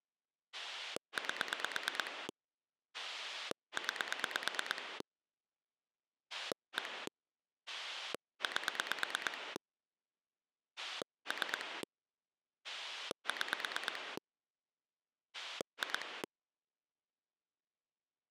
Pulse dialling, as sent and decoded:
8 / 9 / 1 / 8 / 3 / 6 / 2
8 9 1 8 3 6 2

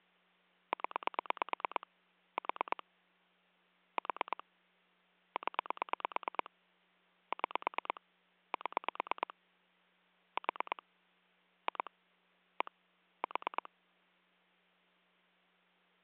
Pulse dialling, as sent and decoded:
10 / 4 / 4 / 10 / 6 / 7 / 4 / 2 / 1 / 4
0 4 4 0 6 7 4 2 1 4

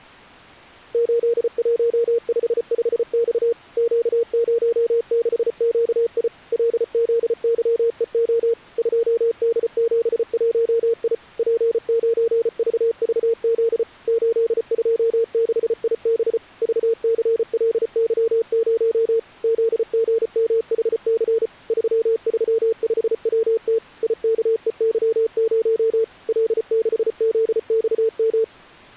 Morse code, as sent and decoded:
---.. .---- ..... ..... -..- / --.- ----- -.... --.- .. / .-.. --.. -.-- . --- / ..--- -.. --... .---- .. / .--. ----. ...- ...- --.. / ---.. ..--- -.... .. -... / ...- -.-. .-.. -.-- ----- / --.. --. -- .... -.-. / ...-- ...-- ..... .-- - / .. -.- . -.-- ----- / .-.. -.... --.. -..- --
8155X Q06QI LZYEO 2D71I P9VVZ 826IB VCLY0 ZGMHC 335WT IKEY0 L6ZXM

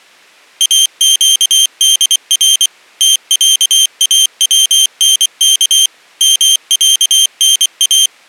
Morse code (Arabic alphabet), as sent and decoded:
.- --.- -.. .-. / - .-.- .- .-- -. -.- / -- .-.- -. .-
اقدر تعاونك معنا

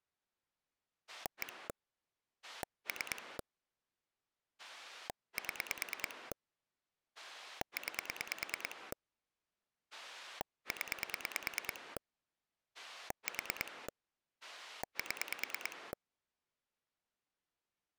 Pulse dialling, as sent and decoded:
1 / 3 / 7 / 9 / 10 / 4 / 7
1 3 7 9 0 4 7

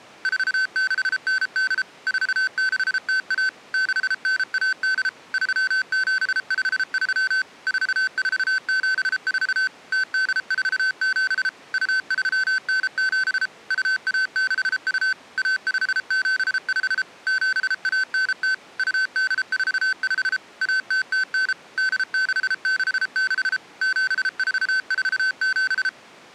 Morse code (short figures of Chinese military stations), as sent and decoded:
....- -.... -. -.. / ....- -.... - .- / -.... -. .- -.. / ...-- --... ..... ...-- / ....- ....- --... ....- / - -.. ....- --... / ..- ...-- -. --... / ..- .- -.... ..- / .- ..... --... ..... / --... .- -. - / ..- -.. ....- ..... / .- - - -. / -.. -.... -.... -.... / --... ....- ....- --...
4698 4601 6918 3753 4474 0847 2397 2162 1575 7190 2845 1009 8666 7447

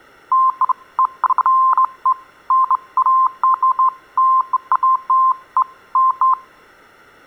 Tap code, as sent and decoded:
none

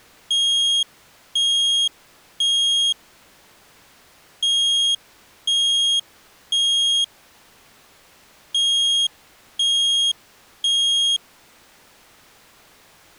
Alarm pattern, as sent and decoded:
3 beeps and a pause
temporal three

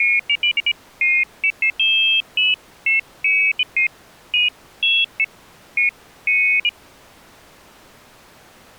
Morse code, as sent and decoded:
none

